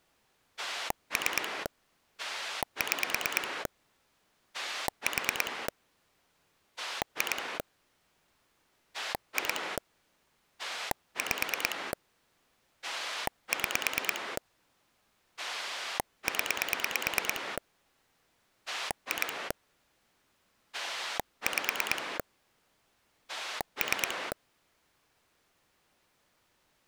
Pulse dialling, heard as a rotary dial, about 9 pulses a second. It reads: 3 6 4 2 2 5 6 0 2 5 3